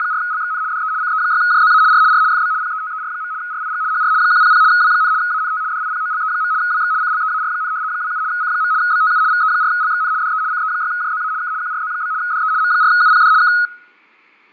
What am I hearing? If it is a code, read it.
RTTY (75 baud, 170 Hz shift), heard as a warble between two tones, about 1360 Hz centre, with fading. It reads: … DE CE6JZA R R FB PETER. RIG HR 100 W, ANT DIPOLE. WX CLEAR, 27 C. BTU VE4LXN DE CE6JZA K QRZ? DE M4UPD K